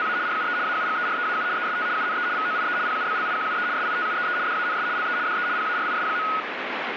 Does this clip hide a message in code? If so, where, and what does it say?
Yes: RTTY (75 baud, 170 Hz shift) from 0.0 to 6.4 s, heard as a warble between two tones, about 1360 Hz centre, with radio static. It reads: … RUE AUGEREAU EST UNE VOIE PUBLIQUE SITUEE DANS LE DE PARIS.